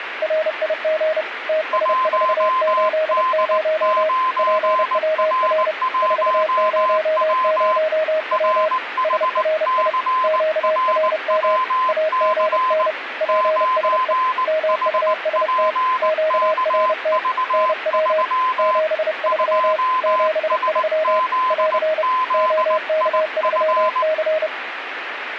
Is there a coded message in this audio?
Yes: Morse code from 0.2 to 24.5 s, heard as two keyed tones, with radio static. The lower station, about 30 wpm, 630 Hz: RIG TS480 PWR 400W SRI QRM AGN PSE MUST QRT NW 73 73 <AR> OK3C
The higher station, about 19 wpm, 1030 Hz: 1D9R1W RHCRWC 9HPKV3 2SZZIF